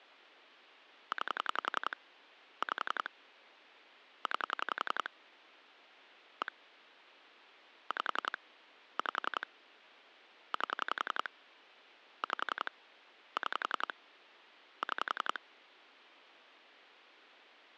Pulse dialling, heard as clicks on a phone line, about 11 pulses a second. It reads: 9 5 9 1 5 5 8 5 6 6